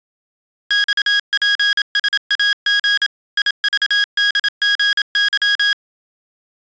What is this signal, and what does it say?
Morse code, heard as electronic beeps, machine-sent, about 27 wpm, 1650 Hz. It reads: XPSAG IVDGY